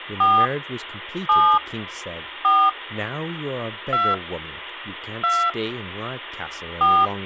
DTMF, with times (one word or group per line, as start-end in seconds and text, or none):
0.2-0.5 4
1.3-1.6 7
2.4-2.7 4
3.9-4.1 2
5.2-5.5 2
6.8-7.1 4